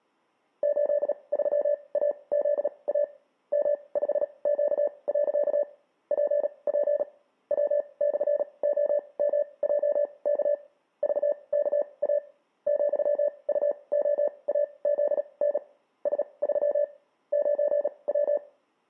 Morse code, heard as a keyed tone, machine-sent, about 37 wpm, spaced as for 26 wpm, 580 Hz, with room echo. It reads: 83AZA M5Q. PP W/OMJK VKA ,UOAZN S3 9W